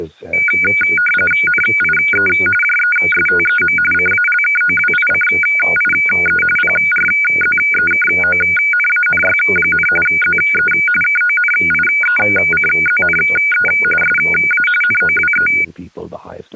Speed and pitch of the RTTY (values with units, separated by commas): 45.45 baud, 850 Hz shift, 1850 Hz centre